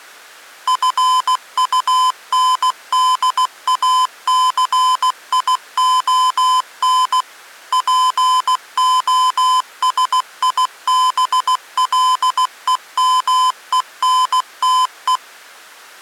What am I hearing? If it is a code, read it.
Morse code, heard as electronic beeps, machine-sent, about 16 wpm, 1020 Hz. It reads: FUNDACION POSIBLEMENTE